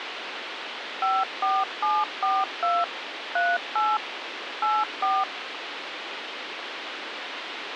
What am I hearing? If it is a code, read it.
DTMF, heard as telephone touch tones, dialled by machine, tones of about 220 ms, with radio hiss. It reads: 54742 38 84